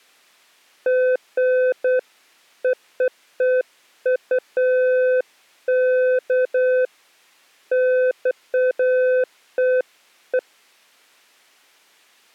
Beeps of irregular length. There is no code.